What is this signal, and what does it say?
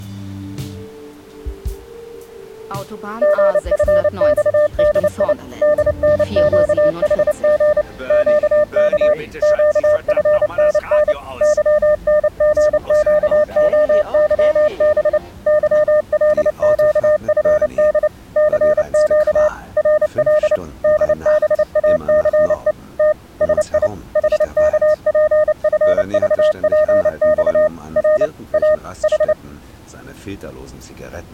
Morse code, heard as a keyed tone, machine-sent, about 29 wpm, 610 Hz. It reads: GFXDI DNQHG QK QFNN YNGQOYB YLQFD CQ RL DBACE T SI HKPFVPX R A H